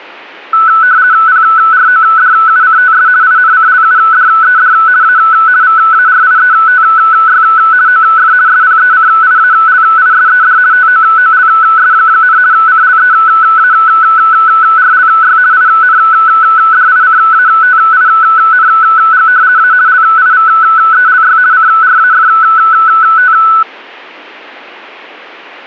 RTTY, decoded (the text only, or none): PRODUCTS INCLUDED A VARIETY OF SPECIALISED TOOLS, CLEARLY INDICATING A LIVELY CRAFT